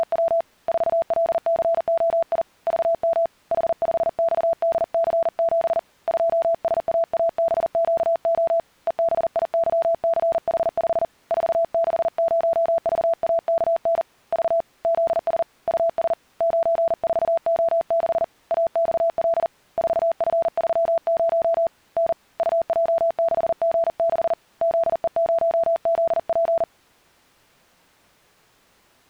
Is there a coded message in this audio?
Yes: Morse code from 0.0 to 26.7 s, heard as a keyed tone, hand-sent with a paddle, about 40 wpm, 670 Hz. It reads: … 4LCOI VM H5XDC7 2SAABQO EBIYCH5 460VAKN V ZS US 94O6 AXL 4F30 N UJ6G6 ZE0ZP